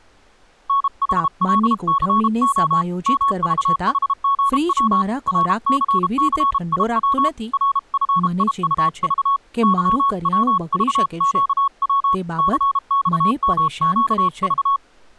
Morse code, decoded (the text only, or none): NHLCO MVHGW RCCIW RFIUV YWVQW CXMQV